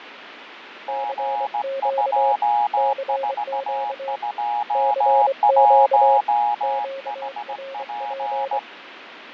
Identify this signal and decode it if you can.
Morse code, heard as two keyed tones, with radio static and fading. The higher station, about 17 wpm, 830 Hz: G2421HP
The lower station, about 24 wpm, 540 Hz: CQ CQ CQ QRP